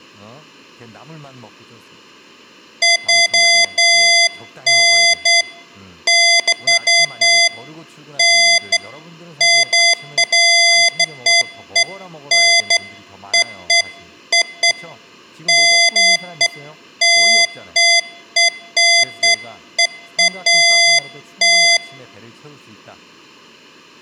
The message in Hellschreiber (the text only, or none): none